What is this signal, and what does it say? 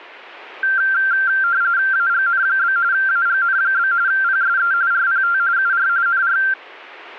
RTTY (45.45 baud, 170 Hz shift), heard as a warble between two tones, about 1470 Hz centre. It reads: AGN? AGN? PSE RPT UR NR